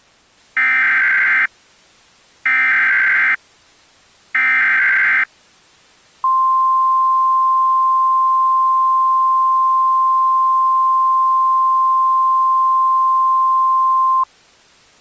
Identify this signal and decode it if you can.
Emergency Alert System (SAME) tones (header bursts, then the 1050 Hz attention tone), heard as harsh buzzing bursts, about 520.83 baud.